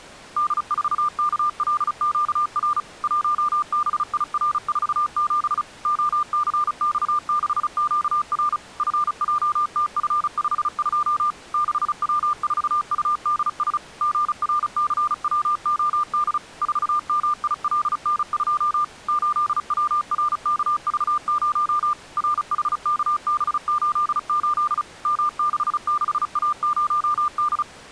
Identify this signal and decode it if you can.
Morse code, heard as a keyed tone, machine-sent, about 35 wpm, 1200 Hz. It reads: D4KLQR 1BIR47 OCX6QR FJTF52 6W4UDS GRCWOD 4MILN2 8WRKV0 RHKB88 M66A0D